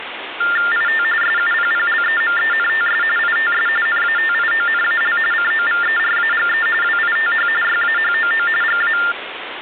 TTY/TDD text telephone tones (45.45 baud Baudot), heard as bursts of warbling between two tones, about 400 Hz shift, 1600 Hz centre, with phone line noise. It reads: IT SUPPLEMENTS ITS NATIONAL COVERAGE WITH YAHOO GA